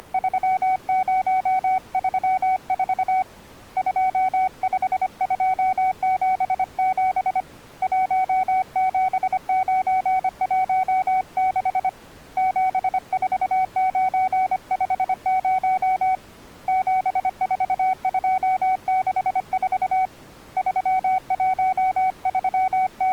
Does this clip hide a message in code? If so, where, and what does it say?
Yes: Morse code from 0.0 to 23.1 s, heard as a keyed tone, hand-sent with a paddle, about 25 wpm, 750 Hz. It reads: … 25277 17916 74950 74264 …